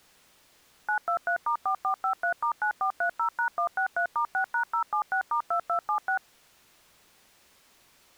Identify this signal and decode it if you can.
DTMF, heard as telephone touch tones, dialled by machine, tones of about 90 ms. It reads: 923*4453*9430#163*6#076*2276